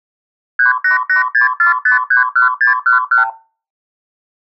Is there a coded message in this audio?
Yes: multi-frequency trunk signalling (R2, with the far end's replies) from 0.6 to 3.3 s, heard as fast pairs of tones, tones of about 130 ms. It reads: 38864531611